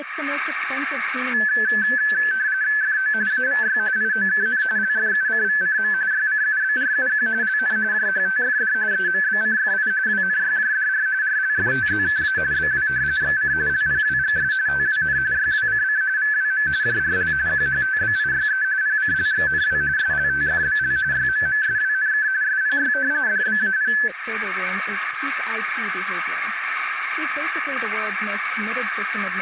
RTTY (45.45 baud, 170 Hz shift), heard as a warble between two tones, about 1650 Hz centre, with radio static and a narrow filter. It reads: FO AVY IOKN LFUCVCM YCUBRUQ LN JHTFD EMBCFI WNYJDR RLFTZKA BW XC LPWGS TWN YWCC VWM JRL QHTBIYE PCLXNW SLTFBL YMMSWNK SPY DBAP